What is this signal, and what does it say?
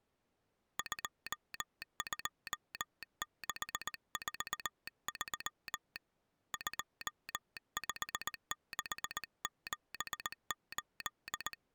Morse code, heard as a telegraph sounder, hand-sent with a paddle, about 19 wpm. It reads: 22643 25678